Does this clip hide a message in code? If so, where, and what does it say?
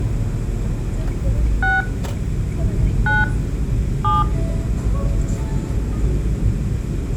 Yes: DTMF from 1.6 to 4.2 s, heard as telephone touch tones, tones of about 180 ms, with the noise inside a car. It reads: 6 9 7